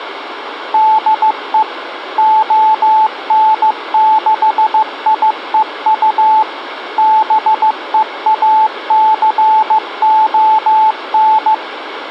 Morse code, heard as a keyed tone, machine-sent, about 15 wpm, 870 Hz, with radio hiss. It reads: DE ON6IEU BEACON